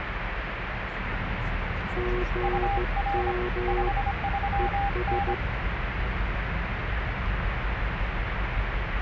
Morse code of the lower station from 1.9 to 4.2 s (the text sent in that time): GM